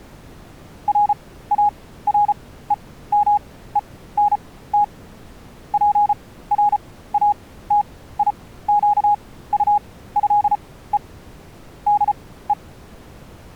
Morse code (with French letters), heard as a keyed tone, machine-sent, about 34 wpm, spaced as for 17 wpm, 830 Hz. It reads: RAREMENT PRATIQUÉE DE